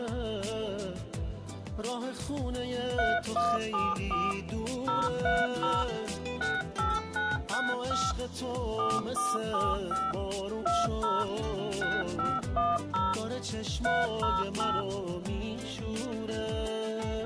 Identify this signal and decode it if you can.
DTMF, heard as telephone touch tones, dialled by machine, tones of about 200 ms. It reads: 3174 030 68965 4475 20 6510 308